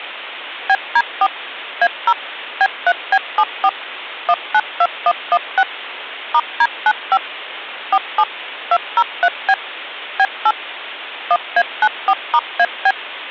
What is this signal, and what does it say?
DTMF, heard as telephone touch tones, dialled by machine, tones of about 50 ms. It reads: BD4 A0 B3B74 192116 *D95 47 203B B8 1A94*AB